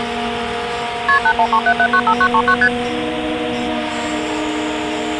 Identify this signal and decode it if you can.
Multi-frequency trunk signalling (R1, as on North American trunks), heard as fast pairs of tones, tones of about 70 ms, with phone line noise. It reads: KP 8137795939 ST